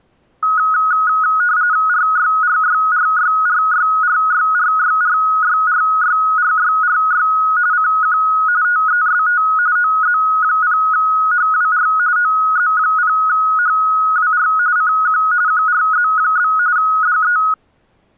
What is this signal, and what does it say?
RTTY (45.45 baud, 170 Hz shift), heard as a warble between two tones, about 1360 Hz centre. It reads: RYRYRYRYRYRYRYRYRYRY CQ TEST OZ0HWR OZ0HWR CQ QRZ? DE